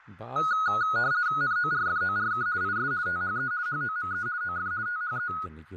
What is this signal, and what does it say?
RTTY (50 baud, 170 Hz shift), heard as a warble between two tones, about 1360 Hz centre, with fading and speech in Kashmiri. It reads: NORFORK IS THE HOME OF THE